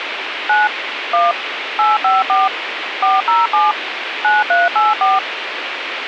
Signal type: DTMF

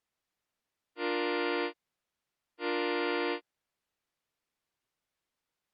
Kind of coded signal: train horn signal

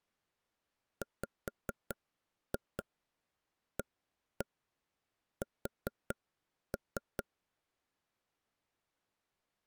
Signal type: tap code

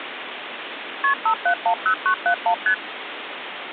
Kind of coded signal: multi-frequency trunk signalling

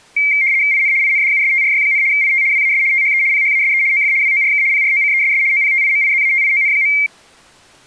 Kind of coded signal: RTTY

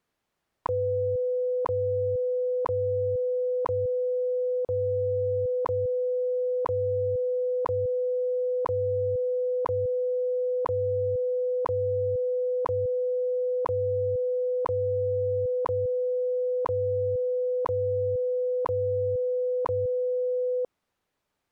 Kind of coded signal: radio time signal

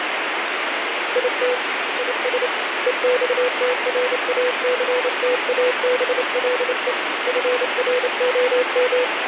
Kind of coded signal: Morse code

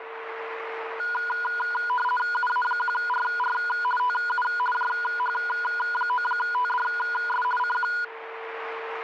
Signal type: RTTY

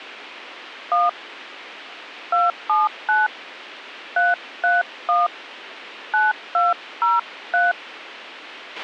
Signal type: DTMF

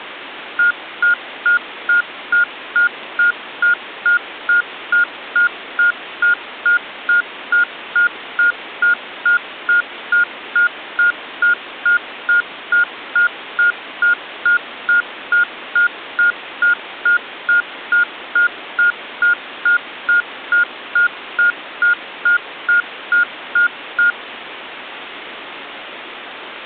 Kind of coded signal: none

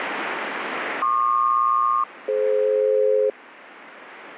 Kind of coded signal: aircraft SELCAL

